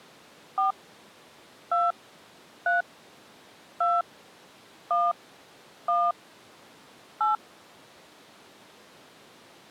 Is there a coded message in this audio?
Yes: DTMF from 0.6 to 7.4 s, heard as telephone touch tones, dialled by hand, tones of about 180 ms. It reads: 4 2 3 2 1 1 8